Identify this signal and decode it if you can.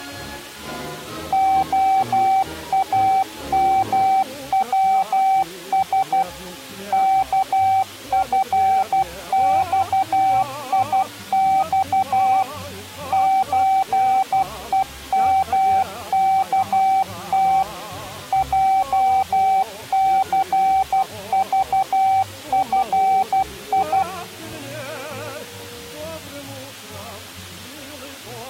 Morse code (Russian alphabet), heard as a keyed tone, machine-sent, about 12 wpm, 770 Hz. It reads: ОАМВС КФЬИЬ ЧЕМКТ ЙЦЖФИ